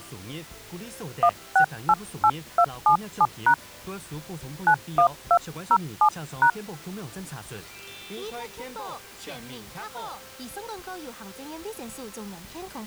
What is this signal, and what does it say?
DTMF, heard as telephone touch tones, dialled by hand, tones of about 80 ms. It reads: 1688277# 91207#